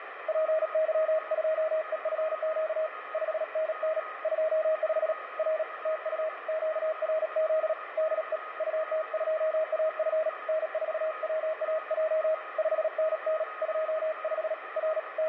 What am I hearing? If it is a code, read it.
Morse code, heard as a keyed tone, hand-sent with a paddle, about 37 wpm, 630 Hz, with radio static and a weaker station near 1250 Hz. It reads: PY2EFQ 5NN 25 R TU QRZ DE UT2AF N4WAJ 5NN 25 R …